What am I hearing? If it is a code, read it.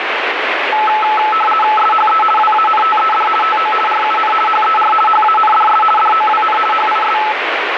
RTTY (50 baud, 450 Hz shift), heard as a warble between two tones, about 1080 Hz centre, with radio static. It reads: SHE WANTED TO RUN HER HANDS DOWN HIS